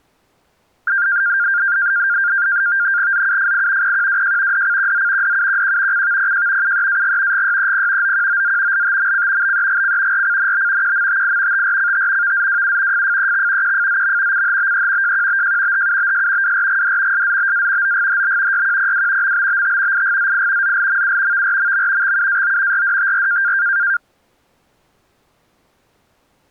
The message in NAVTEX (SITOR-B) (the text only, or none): ZUFI PQWJ DCQZ DUQQ CVPJ UEAG GYEP OQOZ LTMC BEGC RCNB QMTI TRCT VZWU FFEX QFZM CHBE JQBJ HUBS WRGD SZBA OGHB YQPW MBBT IGZI ZLMU VRMM XUAO RDTR